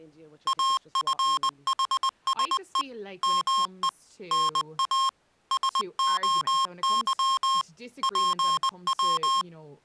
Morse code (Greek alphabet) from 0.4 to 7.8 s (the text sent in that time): ΑΦΗΣΕ ΜΕ ΝΑ ΣΟΥ